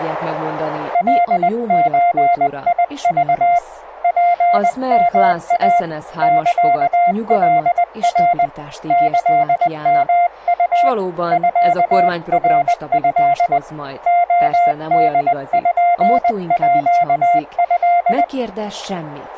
Morse code (Japanese Wabun code), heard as a keyed tone, hand-sent with a paddle, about 20 wpm, 700 Hz, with speech in Hungarian. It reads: カゾク ツヨイ サカナ キヨウ ミナト レポート